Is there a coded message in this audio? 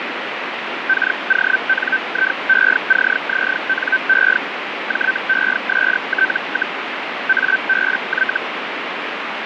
Yes: Hellschreiber (Feld-Hell, 122.5 baud) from 0.9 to 8.4 s, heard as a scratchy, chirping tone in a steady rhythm, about 1550 Hz, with radio static. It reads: KONIECZNE JEST, ABY